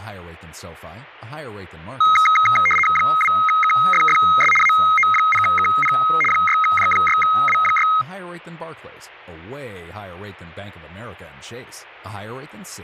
RTTY (75 baud, 850 Hz shift), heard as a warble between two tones, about 1700 Hz centre, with speech in English. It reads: 2KFFS AO0KP 6J6W6